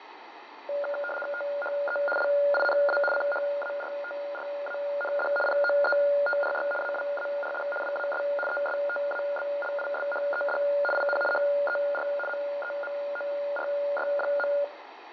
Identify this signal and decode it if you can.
RTTY (75 baud, 850 Hz shift), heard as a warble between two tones, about 1000 Hz centre, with radio static and fading. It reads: THE LINA CHARTRAND POETRY AWARD WAS ESTABLISHED IN HER MEMORY.